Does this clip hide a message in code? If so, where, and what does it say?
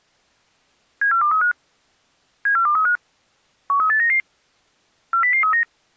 Yes: five-tone selective call (CCIR) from 1.0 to 5.6 s, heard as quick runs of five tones, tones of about 100 ms. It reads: 74235 74235 13899 40039